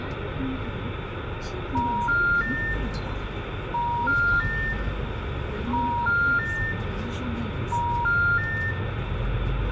Telephone call progress tone (ITU plan), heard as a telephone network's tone, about 950, 1400, 1800 Hz, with phone line noise, room echo and the noise inside a bus. Special information tone.